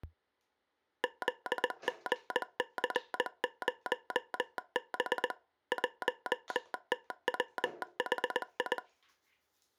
Morse code, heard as a telegraph sounder, machine-sent, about 20 wpm, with the noise of a restroom. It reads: ZGC0B 1TWHI